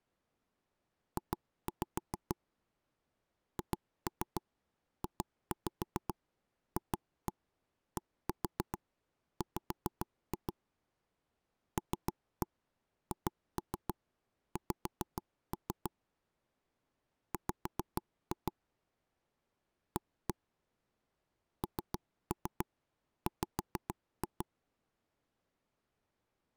Tap code, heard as taps on a table, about 6 knocks a second. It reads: J HJFDW LHX W A NW